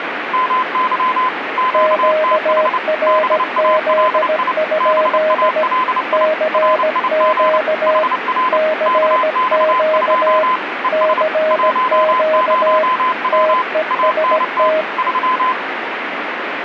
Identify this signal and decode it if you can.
Morse code, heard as two keyed tones, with radio static. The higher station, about 29 wpm, 1020 Hz: MY QTH BALI BALI RIG HR KX2 ES 10W ANT 3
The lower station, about 17 wpm, 620 Hz: QRZ? CQ CQ CQ TEST